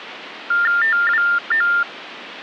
TTY/TDD text telephone tones (45.45 baud Baudot), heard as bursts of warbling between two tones, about 400 Hz shift, 1600 Hz centre. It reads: TWO